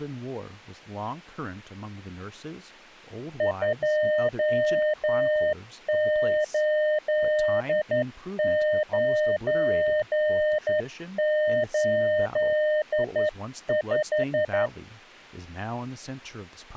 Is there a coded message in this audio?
Yes: Morse code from 3.3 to 14.7 s, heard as a keyed tone, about 11 wpm, 610 Hz, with speech in English. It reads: 28985